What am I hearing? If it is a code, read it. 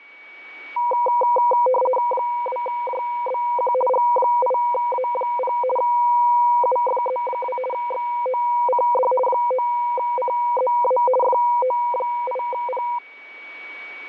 RTTY (50 baud, 450 Hz shift), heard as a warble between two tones, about 740 Hz centre, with a steady whistle near 2260 Hz. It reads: 2JBQ G8A0 UFZ2 XOCD 9CZA FO8P